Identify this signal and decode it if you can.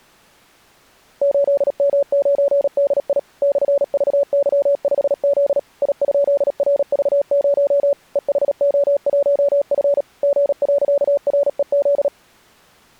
Morse code, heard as a keyed tone, machine-sent, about 37 wpm, 570 Hz. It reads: 8M9DI /VY5Z I?RV0 EHO1F G.REZ